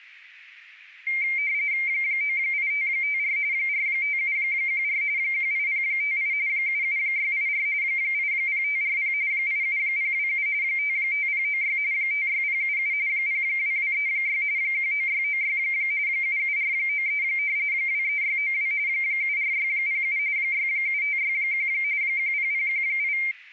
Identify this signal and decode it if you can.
RTTY (45.45 baud, 170 Hz shift), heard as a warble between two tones, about 2200 Hz centre. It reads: 98554 45714 18058 77684 80540 87027 55096 56077 02236 19696 77493 23692 74607 67561 10018